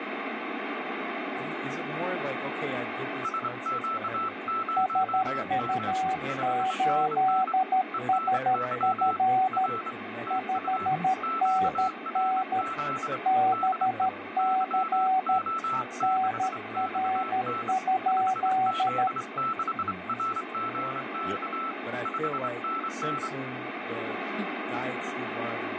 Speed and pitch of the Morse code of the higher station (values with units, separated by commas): 25 wpm, 1320 Hz